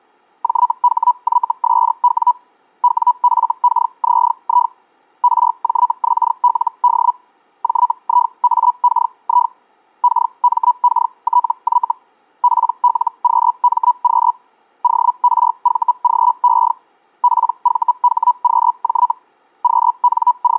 Hellschreiber (Feld-Hell, 122.5 baud), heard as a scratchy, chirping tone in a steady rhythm, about 980 Hz. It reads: JHYSW WFKZI RJXLD JIAKI KMKTY PLQMQ ORVGE PVHQJ …